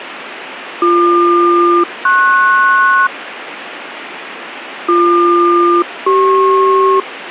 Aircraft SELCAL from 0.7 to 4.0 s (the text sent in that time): BQ-PS